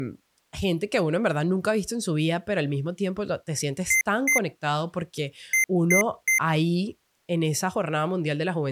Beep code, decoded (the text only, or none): 2-3